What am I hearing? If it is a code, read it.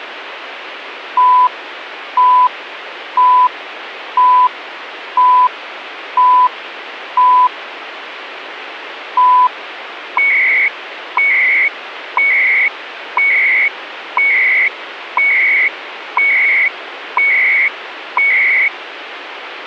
Radio time signal (CHU, Canada), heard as beeps and data bursts, one a second, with radio static.